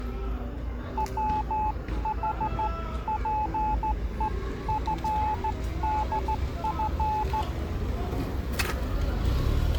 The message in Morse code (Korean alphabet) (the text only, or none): 부자는